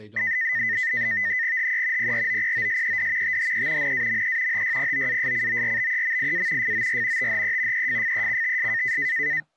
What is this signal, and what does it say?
NAVTEX (SITOR-B), 100 baud, 170 Hz shift, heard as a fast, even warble, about 1900 Hz centre, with speech in English. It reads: HE PROPOSED THE NAME HYPOASCORBEMIA FOR THE EFFECTS